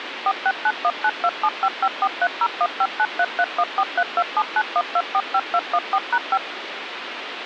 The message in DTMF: 469192755430159331432791245214#5

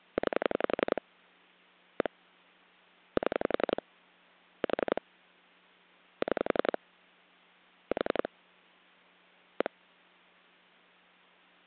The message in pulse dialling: 9 1 7 4 6 4 1

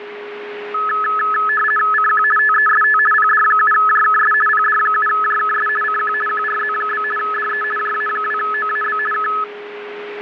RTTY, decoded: CQ TEST PD7JKS PD7JKS CQ QRZ? DE JA2OAB K

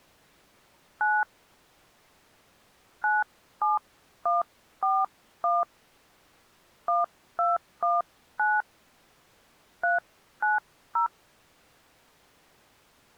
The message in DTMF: 9 97141 1219 390

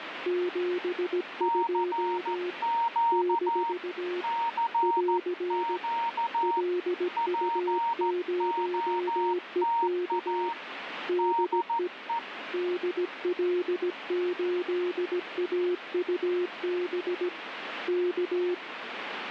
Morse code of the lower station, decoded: 72 - <AR> LU0EK DE DL8AUB K

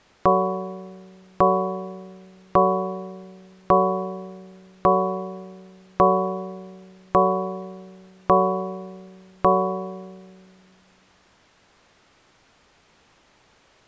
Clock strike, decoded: 9

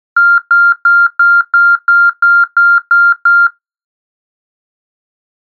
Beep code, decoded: 10 short

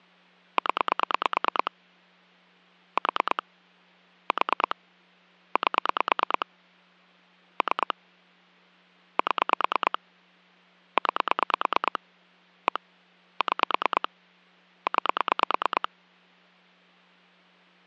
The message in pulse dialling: 0 4 4 8 3 7 9 1 6 9

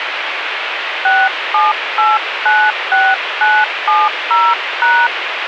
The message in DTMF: 67896970#

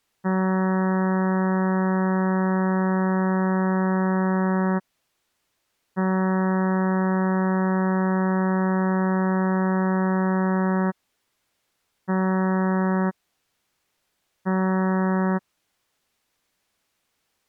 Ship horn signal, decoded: 2 long, 2 short

